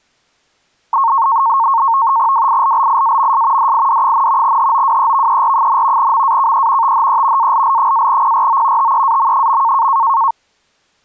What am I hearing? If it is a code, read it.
NAVTEX (SITOR-B), 100 baud, 170 Hz shift, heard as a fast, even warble, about 1000 Hz centre. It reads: WILLIAMS DID, HOWEVER, MAKE THE ALL-PRO TEAM.